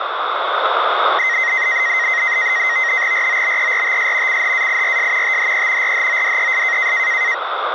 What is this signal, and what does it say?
NAVTEX (SITOR-B), 100 baud, 170 Hz shift, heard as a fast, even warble, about 1950 Hz centre, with radio static. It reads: ROBERTS CHAIRS THE RHODES